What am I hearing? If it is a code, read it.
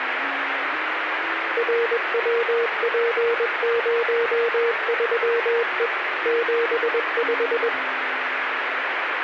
Morse code, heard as a keyed tone, machine-sent, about 21 wpm, 470 Hz, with radio static. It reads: RWP03E 75